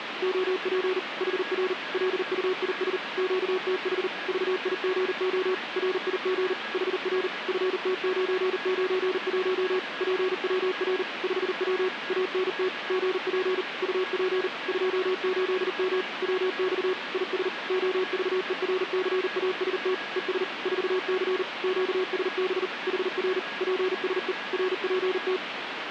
Morse code, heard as a keyed tone, machine-sent, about 39 wpm, 370 Hz, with radio static and a weaker station near 1650 Hz. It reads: OP HR LUIS QTH VIGO RIG HR FT991 PWR 5W ANT GP UP 28M WX IS OVERCAST ES 4C QSB HR PSE RPT